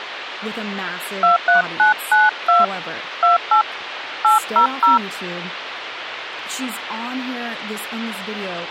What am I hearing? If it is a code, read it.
DTMF, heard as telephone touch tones, dialled by hand, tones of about 140 ms, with phone line noise and speech in English. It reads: 23992 28 800